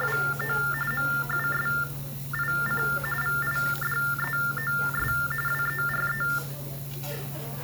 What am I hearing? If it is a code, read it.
TTY/TDD text telephone tones (45.45 baud Baudot), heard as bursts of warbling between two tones, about 400 Hz shift, 1600 Hz centre, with the noise of a restaurant. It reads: … MUSIC VIDEOS WERE